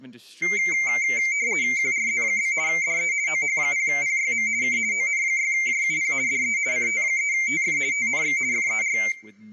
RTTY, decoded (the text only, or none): QRZ? DE OH0PYM K ON6JUP DE CT3TF TNX FER